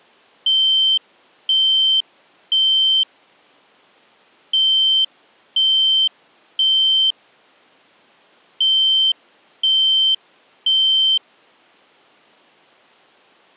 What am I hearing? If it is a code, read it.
Alarm pattern, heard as an alarm's beeps, played three times, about 3100 Hz. Temporal three. Smoke or fire, evacuate.